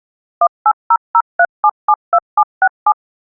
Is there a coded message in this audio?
Yes: DTMF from 0.4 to 2.9 s, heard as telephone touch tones, dialled by machine, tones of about 60 ms. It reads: 18003772767